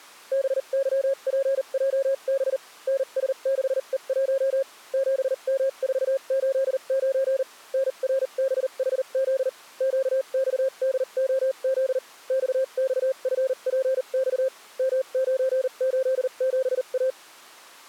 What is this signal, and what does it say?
Morse code, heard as a keyed tone, machine-sent, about 39 wpm, spaced as for 33 wpm, 540 Hz. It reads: BYPJB NS6E1 7M489 NRBHZ QXDOZ XXFPX M987A